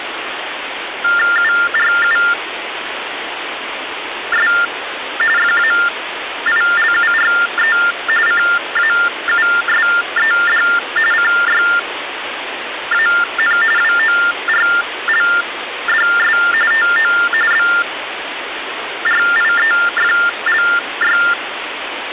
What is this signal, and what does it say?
TTY/TDD text telephone tones (45.45 baud Baudot), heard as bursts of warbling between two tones, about 400 Hz shift, 1600 Hz centre, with phone line noise. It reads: URUS FAILURE CAUSED CYAN WORLDS TO BRIEFLY